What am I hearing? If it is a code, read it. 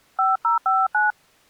DTMF, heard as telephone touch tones, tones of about 170 ms. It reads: 5059